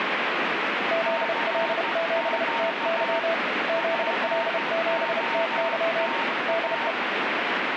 Morse code, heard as two keyed tones, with heavy radio static. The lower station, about 31 wpm, 660 Hz: ZL7TY ZL7TY DE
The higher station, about 15 wpm, 920 Hz: CQ POTA